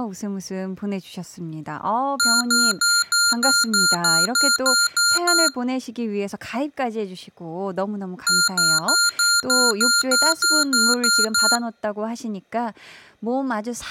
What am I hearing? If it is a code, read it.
Beep code, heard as beeps from a small speaker, played twice, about 1400 Hz, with speech in Korean. 11 short. In AMI BIOS tables: cache memory error.